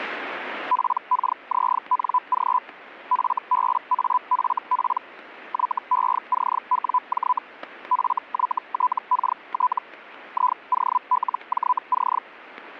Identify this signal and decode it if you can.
Hellschreiber (Feld-Hell, 122.5 baud), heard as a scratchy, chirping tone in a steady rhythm, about 1000 Hz, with static crashes. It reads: PKZNG FBAFP YECWJ FYTKT IOLJC